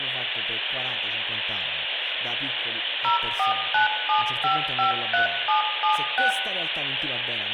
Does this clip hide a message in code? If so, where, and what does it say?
Yes: DTMF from 3.0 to 6.3 s, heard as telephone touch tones, dialled by machine, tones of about 120 ms, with phone line noise, room echo and speech in Italian. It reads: 0497553776